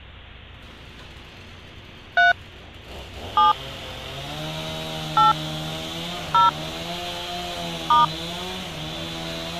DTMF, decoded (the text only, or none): 3 7 8 0 *